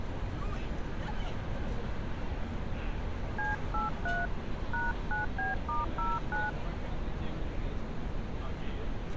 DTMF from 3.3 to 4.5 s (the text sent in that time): C83